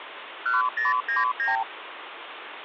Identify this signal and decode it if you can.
Multi-frequency trunk signalling (R2, with the far end's replies), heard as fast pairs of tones, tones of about 160 ms, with phone line noise. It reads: 1099